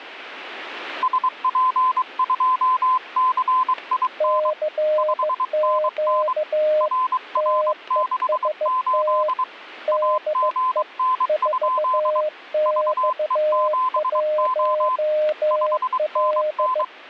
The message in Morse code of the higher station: SP2CIN 5NN RR68 AGN? VE7O 5NN

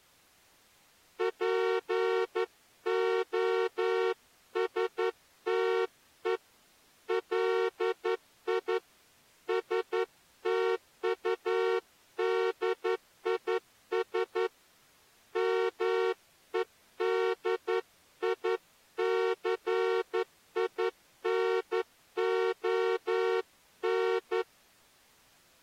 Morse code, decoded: POSTE LI STUDIS MEDICINON

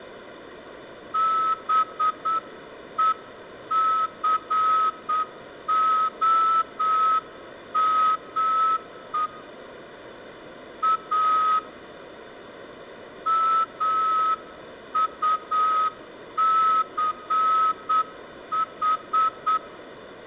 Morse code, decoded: BECOME A MUCH

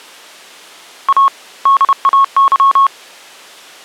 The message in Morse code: A DAY

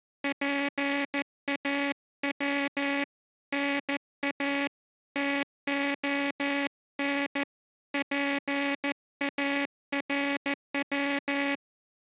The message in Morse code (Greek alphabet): ΠΑΩ ΝΑ ΤΟΝ ΠΑΡΩ

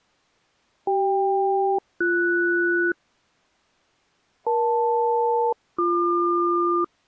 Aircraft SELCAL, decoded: CK-BS EL-BQ

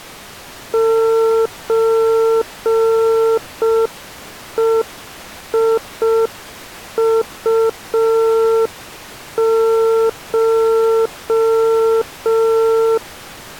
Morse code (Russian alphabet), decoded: ЧЕИУШ

